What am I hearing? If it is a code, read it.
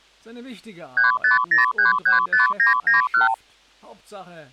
Multi-frequency trunk signalling (R2, with the far end's replies), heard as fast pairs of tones, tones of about 140 ms. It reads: 350335991